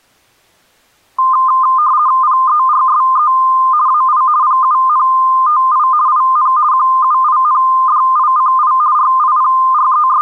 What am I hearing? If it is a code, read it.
RTTY (50 baud, 170 Hz shift), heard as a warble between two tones, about 1130 Hz centre. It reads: PERSE AI PUNTI IN QUINDICI …